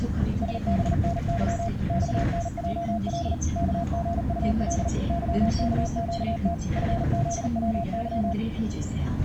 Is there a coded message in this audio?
Yes: Morse code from 0.4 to 8.4 s, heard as a keyed tone, machine-sent, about 39 wpm, 680 Hz, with the noise inside a bus. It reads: SBNY XNJL KGUL YKQT FZWY